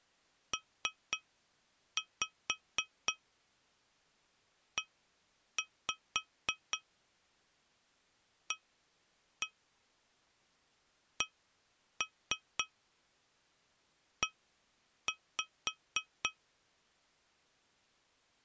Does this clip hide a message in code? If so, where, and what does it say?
Yes: tap code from 0.5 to 16.4 s, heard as taps on glass, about 4 knocks a second. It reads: PEACE